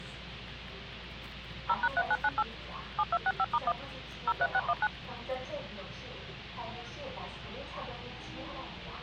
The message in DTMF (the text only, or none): 0#3998 7265*1 03619